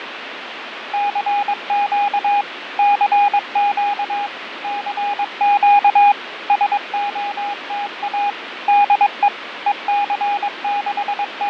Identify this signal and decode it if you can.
Morse code, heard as a keyed tone, machine-sent, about 22 wpm, 820 Hz, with radio static and fading. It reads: CQ CQ CQ SOTA DE …